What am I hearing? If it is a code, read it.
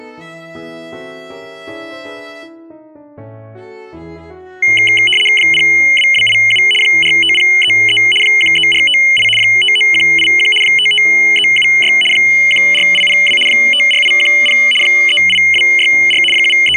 RTTY (75 baud, 850 Hz shift), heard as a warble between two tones, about 2550 Hz centre. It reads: 02287 45033 13458 59181 55376 14802 54810 38264 …